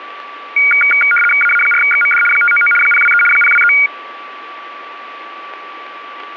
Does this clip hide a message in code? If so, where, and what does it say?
Yes: RTTY (75 baud, 850 Hz shift) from 0.6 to 3.9 s, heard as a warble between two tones, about 1850 Hz centre, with radio static, static crashes and a steady whistle near 1160 Hz. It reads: AA4XMD 599 023 023